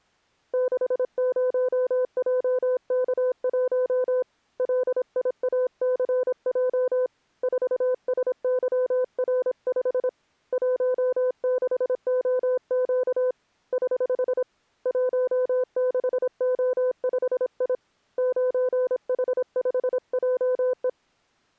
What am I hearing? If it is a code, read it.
Morse code, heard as a keyed tone, hand-sent with a paddle, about 26 wpm, 510 Hz. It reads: 60JK1 LIACJ 4SYR5 16OQ <HH> 16O5I 9H5JE